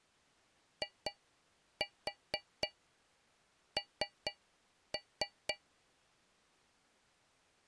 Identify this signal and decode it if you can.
Tap code, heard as taps on a metal pipe, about 4 knocks a second. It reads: IN